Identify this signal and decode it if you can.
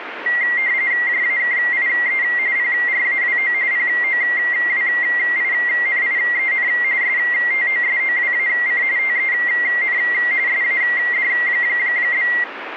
RTTY (45.45 baud, 170 Hz shift), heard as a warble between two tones, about 2000 Hz centre, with radio static. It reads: JAKIE PRAWO POWINIEN STOSOWAC TEN SAD?